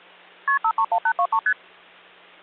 Multi-frequency trunk signalling (R1, as on North American trunks), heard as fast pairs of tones, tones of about 70 ms, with hum. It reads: KP 531823 ST